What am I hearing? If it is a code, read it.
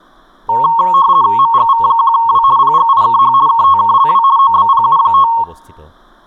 RTTY (50 baud, 170 Hz shift), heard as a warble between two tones, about 1000 Hz centre, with speech in Assamese. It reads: MGV1W PGIKH KTKLW OBPU5